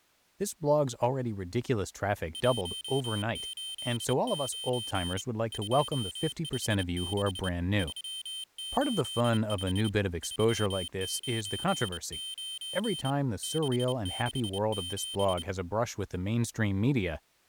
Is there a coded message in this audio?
Yes: Morse code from 2.3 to 15.5 s, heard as a high beeper, hand-sent with a straight key, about 28 wpm, 3100 Hz, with speech in English. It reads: 189 256 385 399 667